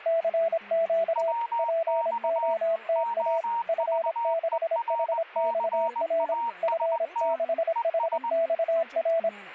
Morse code, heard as two keyed tones, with static crashes and speech in English. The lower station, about 26 wpm, 660 Hz: CQ POTA F6HXR F6HXR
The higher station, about 20 wpm, 930 Hz: WX OVERCAST ES